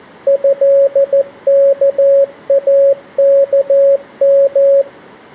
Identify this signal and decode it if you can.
Morse code (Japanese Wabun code), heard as a keyed tone, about 14 wpm, 550 Hz. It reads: トワイワヨ